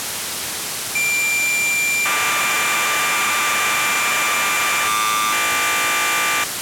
Cassette data (Kansas City type), 1200 baud, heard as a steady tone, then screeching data, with tape hiss.